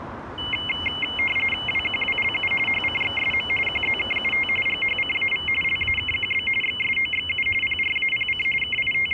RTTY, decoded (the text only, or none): WQWLU HCXSM QZKUT GHCAV LAKQB XSOXU PRAPC …